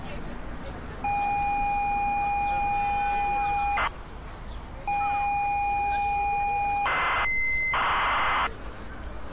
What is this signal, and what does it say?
ZX Spectrum tape loading, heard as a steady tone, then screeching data, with street noise.